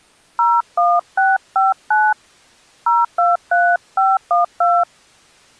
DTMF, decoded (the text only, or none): 01659 023512